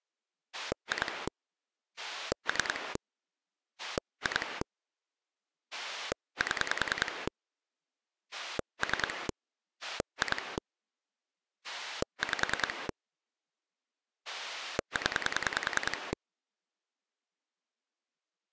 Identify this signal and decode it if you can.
Pulse dialling, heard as a rotary dial, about 10 pulses a second. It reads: 2 3 2 7 3 2 5 0